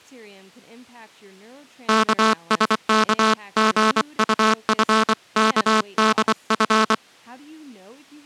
Morse code (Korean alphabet), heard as a buzzer, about 24 wpm, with speech in English. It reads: 영신은